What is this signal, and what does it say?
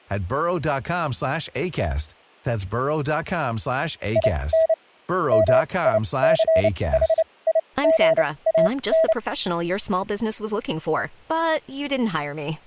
Morse code, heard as a keyed tone, machine-sent, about 29 wpm, spaced as for 21 wpm, 650 Hz, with speech in English. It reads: IN MICHIGAN